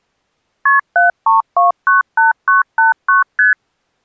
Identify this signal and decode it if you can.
Multi-frequency trunk signalling (R1, as on North American trunks), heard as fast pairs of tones, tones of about 140 ms. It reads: KP 73298989 ST